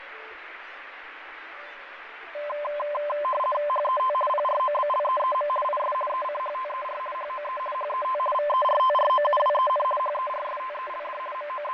RTTY (50 baud, 450 Hz shift), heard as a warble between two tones, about 810 Hz centre, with radio static and fading. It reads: HET PROBLEEM IS ECHTER HOE HET VERTROUWEN HERSTELD …